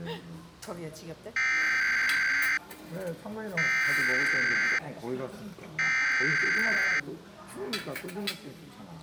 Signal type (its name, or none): Emergency Alert System (SAME) tones